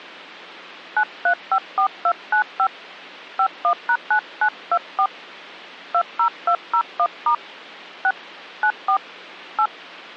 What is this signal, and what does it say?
DTMF, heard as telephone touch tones, dialled by hand, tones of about 80 ms. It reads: 9354295 51#9924 20201* 6 94 8